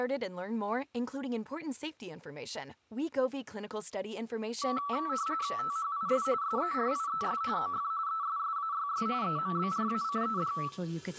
RTTY (45.45 baud, 170 Hz shift), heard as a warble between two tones, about 1230 Hz centre, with room echo. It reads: THIS SERIES OF ESSAYS EMBRACED